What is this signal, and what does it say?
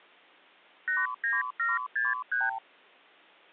Multi-frequency trunk signalling (R2, with the far end's replies), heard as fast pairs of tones, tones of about 180 ms. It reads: 89763